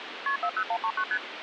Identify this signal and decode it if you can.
Multi-frequency trunk signalling (R1, as on North American trunks), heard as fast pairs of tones, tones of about 70 ms, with phone line noise. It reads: KP 40139 ST